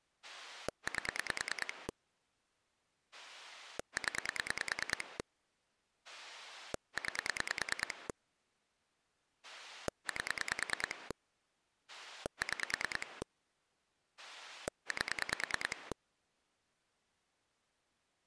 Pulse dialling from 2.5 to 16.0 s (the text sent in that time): 0 9 8 6 8